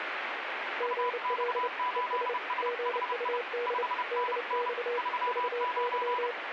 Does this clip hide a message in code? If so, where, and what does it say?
Yes: Morse code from 0.7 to 6.4 s, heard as two keyed tones, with radio static. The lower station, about 29 wpm, 480 Hz: GL ES GUD DX VY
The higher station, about 30 wpm, 990 Hz: UX8SHI 5NN 39